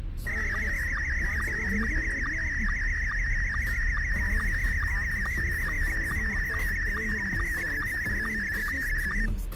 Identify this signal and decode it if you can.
SSTV (slow-scan television), Scottie S1, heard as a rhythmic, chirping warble, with the noise inside a car.